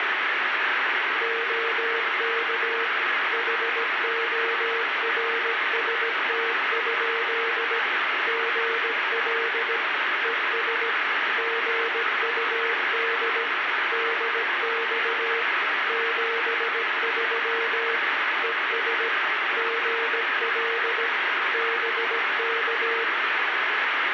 Morse code, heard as a keyed tone, machine-sent, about 17 wpm, 460 Hz, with heavy radio static. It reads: OK HORST? GL ES GUD DX 73 ES GL BK